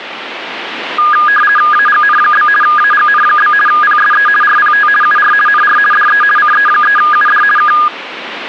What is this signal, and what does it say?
RTTY (50 baud, 450 Hz shift), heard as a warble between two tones, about 1440 Hz centre, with radio static. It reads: AGN? AGN? PSE RPT UR NR DE CE3UD K